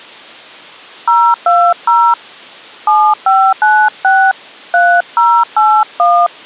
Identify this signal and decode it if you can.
DTMF, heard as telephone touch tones, dialled by hand, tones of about 270 ms. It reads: 020 7596 3081